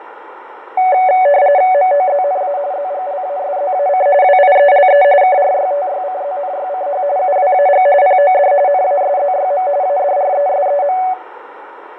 RTTY (45.45 baud, 170 Hz shift), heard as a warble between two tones, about 660 Hz centre, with radio static, fading and a narrow filter. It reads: MOZNA ZGLASZAC WIELE KRYTYCZNYCH UWAG POD NASZYM ADRESEM